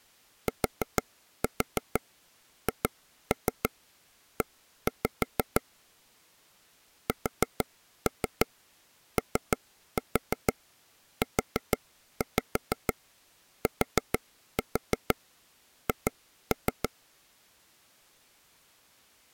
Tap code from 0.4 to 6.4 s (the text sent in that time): THE